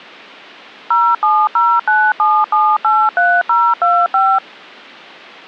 DTMF, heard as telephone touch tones, dialled by machine, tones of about 240 ms. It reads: 07097783025